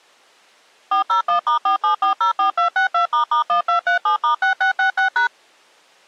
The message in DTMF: 401*47404262**1237*6666#

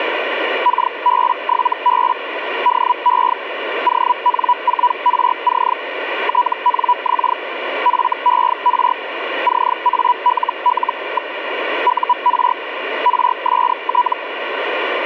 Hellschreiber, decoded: KB7B DE ON4RC TNX FER CALL. UR RST

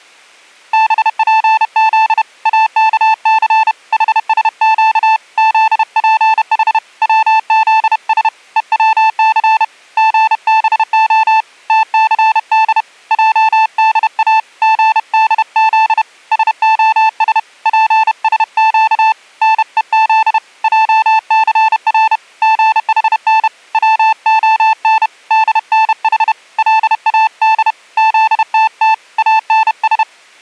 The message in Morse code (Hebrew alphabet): בפז אכס חשק זפח צזש וצס גבה תסד עדא גדז שהש פשק נוז עסר גחן צהן דנח לאד זתת אנש

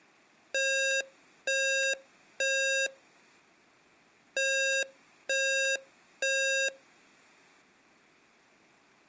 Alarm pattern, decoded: temporal three

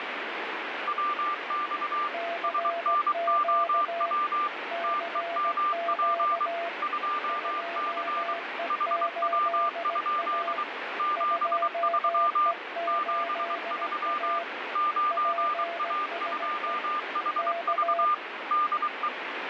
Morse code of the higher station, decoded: WX SNOW TEMP 2C HW? 73 73 9A2HV DE

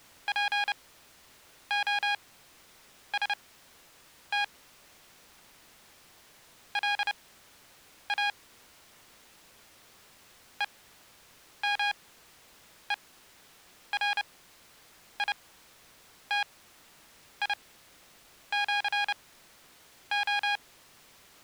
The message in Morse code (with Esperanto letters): POST LA EMERITIĜO

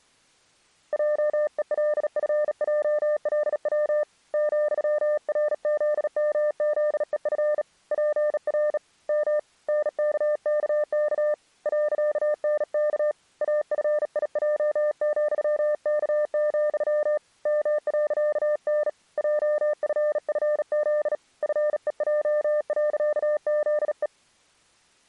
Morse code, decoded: JELFJLW ,RZMZEF PR M NKKK .NK AFIJ,K, M.N JFFZ FEJ.ZE

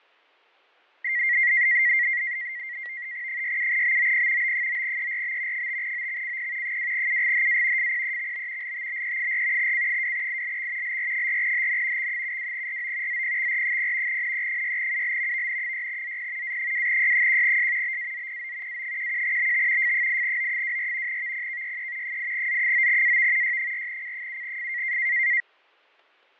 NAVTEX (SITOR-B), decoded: 67BOP B9ERB 5OXCP 2UGHA FPEXB LTBE4 C2ILX LR4HN X72RO ZPXR0 NE6UL VN6ZP A2Y1S BAZPO A11BT F8O24 VPKYE 8Z9AV Y4C7F

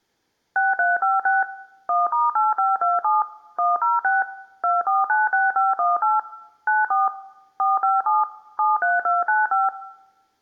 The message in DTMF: 6356 1*8527 106 2496518 94 457 73295

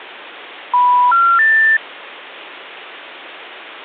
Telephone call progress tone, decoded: special information tone

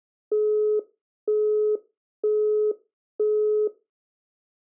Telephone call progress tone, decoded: busy tone

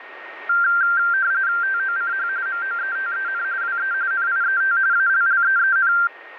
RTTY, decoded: TOCH MOETEN WE NIET ALLEEN

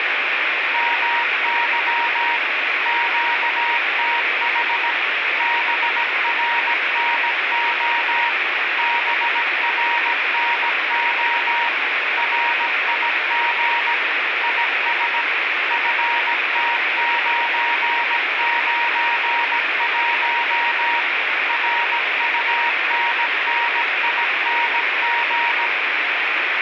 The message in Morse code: MY QTH BRNO BRNO RIG IS FT991 RUNNING

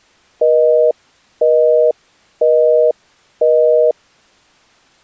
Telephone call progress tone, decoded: busy tone

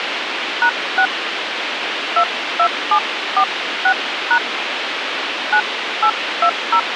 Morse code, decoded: none

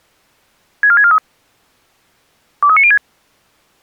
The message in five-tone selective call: 64643 23906

